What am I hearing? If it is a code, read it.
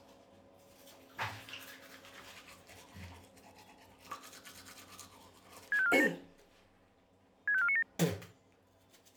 Five-tone selective call (ZVEI), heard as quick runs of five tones, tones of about 70 ms, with the noise of a restroom. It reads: 65497 65497